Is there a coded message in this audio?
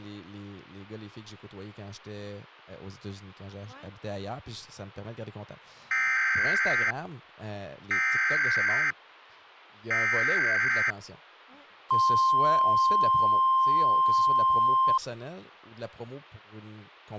Yes: Emergency Alert System (SAME) tones (header bursts, then the 1050 Hz attention tone) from 5.9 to 15.0 s, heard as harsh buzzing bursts, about 520.83 baud, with speech in French.